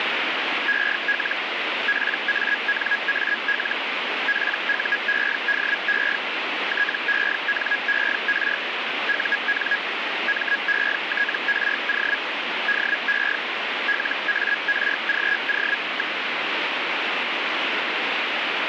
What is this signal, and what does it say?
Hellschreiber (Feld-Hell, 122.5 baud), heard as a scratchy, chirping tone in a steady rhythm, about 1650 Hz, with radio static. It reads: EL PANAL PUEDE TENER UN METRO DE LARGO.